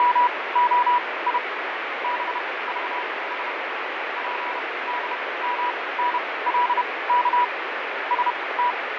Morse code, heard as a keyed tone, machine-sent, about 31 wpm, spaced as for 20 wpm, 980 Hz, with heavy radio static and fading. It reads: … BVS PDMNLK …